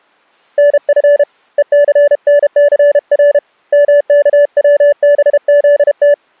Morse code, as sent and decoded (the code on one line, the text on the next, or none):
-. ..-. / . -.-. -. -.-. .-. / -- -.- .-- -... --.. -
NF ECNCR MKWBZT